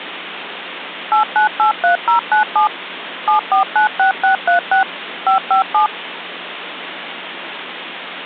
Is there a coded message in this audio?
Yes: DTMF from 1.1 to 5.9 s, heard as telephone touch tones, dialled by machine, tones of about 120 ms, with phone line noise. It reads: 8983097 7496636 557